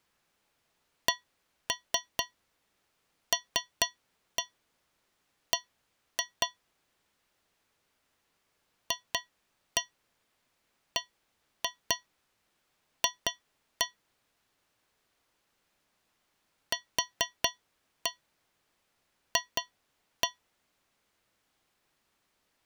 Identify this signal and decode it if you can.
Tap code, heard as taps on a metal pipe, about 4 knocks a second. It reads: CLB FBF QF